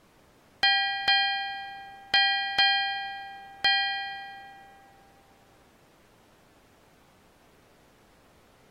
Ship's bell, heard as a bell. 5. Five half-hours of the watch have passed.